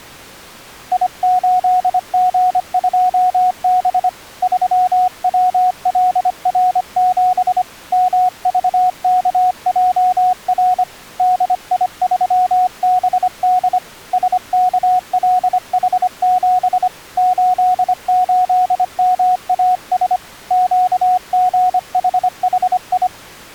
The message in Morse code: I8G2B 3WLR7 MVKJR DI3BD SKLH7 88MAS QGHHI

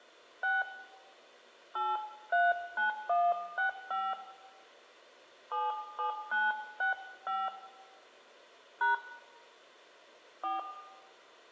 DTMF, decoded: 6 839165 77965 # 4

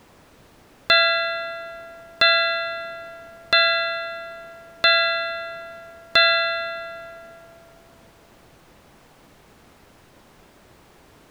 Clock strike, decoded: 5

